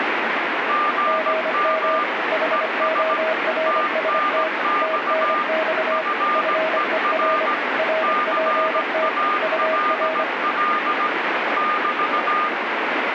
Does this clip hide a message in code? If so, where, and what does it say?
Yes: Morse code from 0.6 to 12.5 s, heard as two keyed tones, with heavy radio static. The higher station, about 17 wpm, 1210 Hz: GM ES TNX FER CALL <BT>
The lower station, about 25 wpm, 640 Hz: GM HORST TNX FER RPT UR